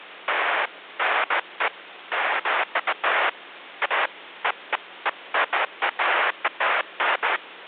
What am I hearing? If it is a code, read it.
Bursts of noise, with phone line noise. There is no code.